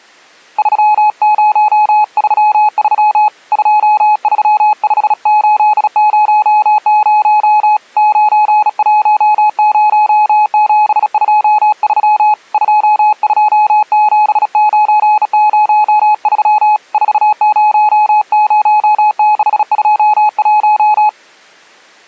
Morse code, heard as a keyed tone, hand-sent with a bug key, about 36 wpm, 850 Hz. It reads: 3033 235800 910723 227903 400621